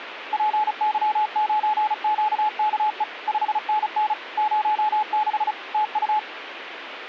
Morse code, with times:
0.3-3.0 PY9QKE
3.3-4.1 5NN
4.4-5.5 06
5.7-6.2 TU

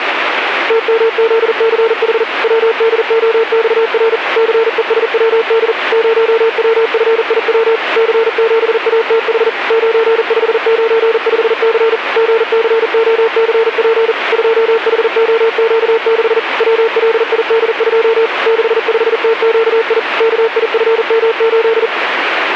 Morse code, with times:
0.7-2.2 TMZCH
2.4-4.2 WDOXR
4.4-5.7 CESWD
5.9-7.8 0WFIW
8.0-9.5 C7ATH
9.7-12.0 9595C
12.2-14.1 GCOCP
14.3-16.4 2HOQ6
16.6-18.3 WLID2
18.5-20.0 65TQI
20.2-21.9 KIFM8

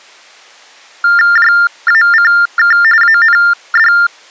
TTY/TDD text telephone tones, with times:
1.4-2.8 JACK
3.0-3.9 AND

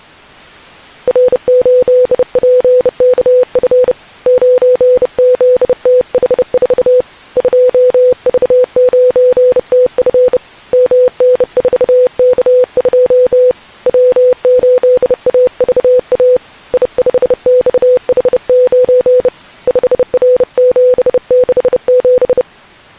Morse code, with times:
1.1-3.9 R8PKF
4.3-7.0 9ZTH4
7.4-10.4 2V9TF
10.7-13.5 MN4K2
13.9-16.4 W8AVA
16.7-19.3 I5XH9
19.7-22.4 5R767

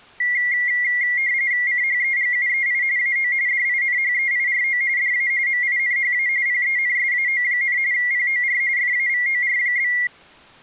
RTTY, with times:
1.7-2.8 CHEGUEI
3.0-3.3 AO
3.5-4.8 DINHEIRO
5.0-5.3 DA
5.5-6.3 MINHA
6.5-7.8 PENSAO,
7.9-8.6 POR
8.8-9.9 FAVOR?

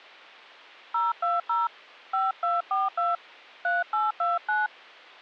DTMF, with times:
0.9-1.7 020
2.1-3.2 5242
3.6-4.7 3829

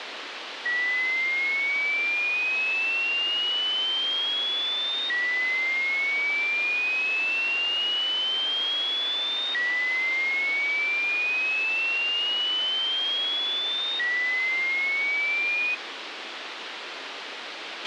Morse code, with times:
none

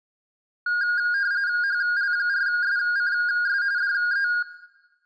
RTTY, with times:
1.6-3.6 HL4SCS
3.8-4.3 DE

